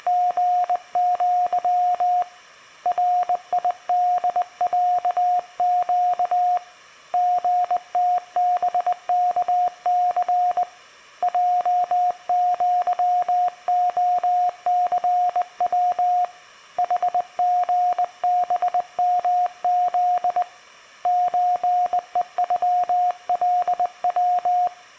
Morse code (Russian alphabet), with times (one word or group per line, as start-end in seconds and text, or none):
0.0-2.2 …
2.9-6.6 РИДЯЩ
7.1-10.6 ГТБКЦ
11.2-16.2 ЙЪОЦВ
16.8-20.4 ХГБМЗ
21.1-24.7 ЧЕЮЛВ